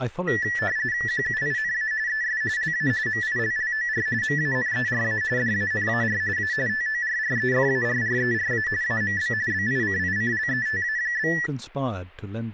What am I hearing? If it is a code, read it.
RTTY (45.45 baud, 170 Hz shift), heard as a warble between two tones, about 1850 Hz centre, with speech in English. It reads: QUINA ES LA MILLOR MANERA DANAR A TORREFARRERA AMB BICICLETA?